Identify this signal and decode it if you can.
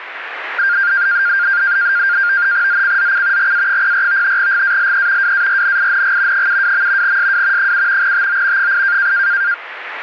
NAVTEX (SITOR-B), 100 baud, 170 Hz shift, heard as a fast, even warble, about 1500 Hz centre, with radio static and static crashes. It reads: ZCZC GA04 GALE WARNING 72. SW 7 TO 8